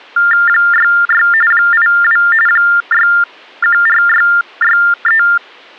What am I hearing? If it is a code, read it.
TTY/TDD text telephone tones (45.45 baud Baudot), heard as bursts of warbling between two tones, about 400 Hz shift, 1600 Hz centre. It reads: 66 82 614663